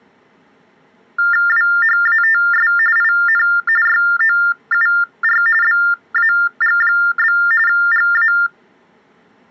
TTY/TDD text telephone tones (45.45 baud Baudot), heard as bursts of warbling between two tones, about 400 Hz shift, 1600 Hz centre. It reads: WHATS IN YOUR BAG? GA